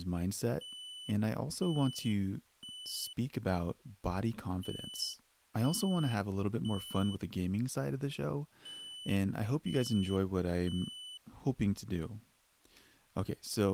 Alarm pattern, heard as an alarm's beeps, played three times, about 3000 Hz, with speech in English. Temporal three. Smoke or fire, evacuate.